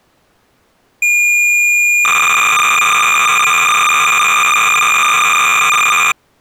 Cassette data (Kansas City type), 300 baud, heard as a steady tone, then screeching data.